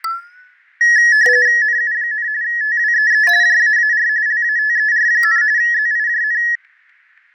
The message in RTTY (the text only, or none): NU, TWEE JAAR LATER, ZIJN